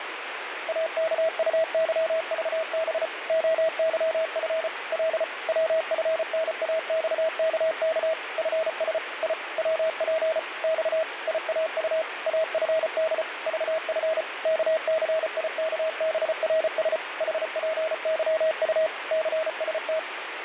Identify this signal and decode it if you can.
Morse code, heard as a keyed tone, machine-sent, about 34 wpm, 640 Hz, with radio static. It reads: AKUYVB OYF L WFNAXKK FS I WP X IAU AFD VF KCIKBRS HPYU CST